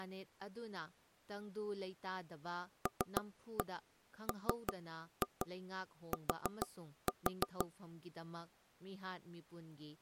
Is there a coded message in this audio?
Yes: tap code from 2.9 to 7.7 s, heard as knocks on wood, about 6 knocks a second, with speech in Manipuri. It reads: LMT